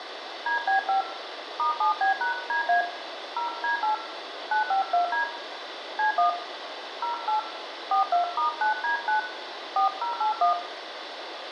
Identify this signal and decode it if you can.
DTMF, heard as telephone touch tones, dialled by hand, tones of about 120 ms, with radio hiss and room echo. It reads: DB5 *7B#DA 0D8 952D C1 08 42*9D9 4081